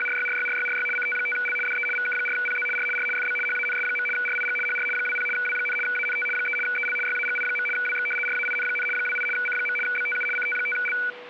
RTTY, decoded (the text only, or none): … CT5L DE VK4PZ R R FB HANS. RIG HR 20 W, ANT 3 EL YAGI. WX RAIN, 28 C. BTU CT5L